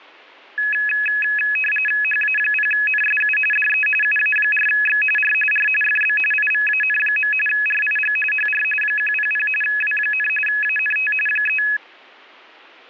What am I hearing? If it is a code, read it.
RTTY (45.45 baud, 850 Hz shift), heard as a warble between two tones, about 2100 Hz centre, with static crashes. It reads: HA0NSU DE UA4X R R FB IVAN. RIG HR 100 W, ANT 3